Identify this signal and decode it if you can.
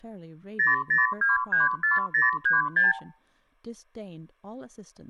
Multi-frequency trunk signalling (R2, with the far end's replies), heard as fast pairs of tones, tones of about 160 ms, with speech in English. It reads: 00234036